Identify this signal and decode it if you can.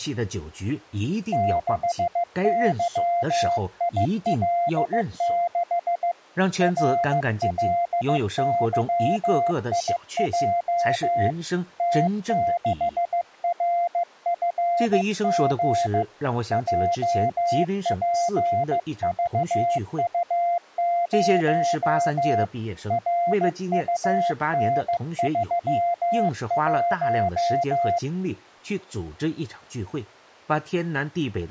Morse code, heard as a keyed tone, hand-sent with a paddle, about 15 wpm, 690 Hz, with speech in Chinese. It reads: 6YIL6 RLYIJ T6RFG JPVU0 RUN31